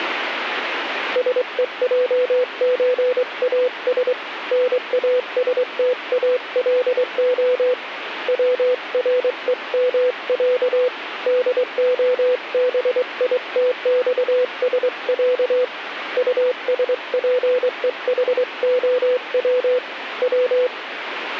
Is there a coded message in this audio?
Yes: Morse code (Russian alphabet) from 1.1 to 20.7 s, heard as a keyed tone, hand-sent with a straight key, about 23 wpm, 500 Hz, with radio static. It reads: СЕЙЧАС НАСТАЛО ВРЕМЯ ДОБИТЬСЯ УСПЕХОВ В